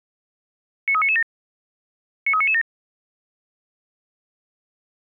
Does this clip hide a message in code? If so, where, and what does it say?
Yes: five-tone selective call (ZVEI) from 0.9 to 2.6 s, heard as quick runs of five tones, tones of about 70 ms. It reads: 93997 93997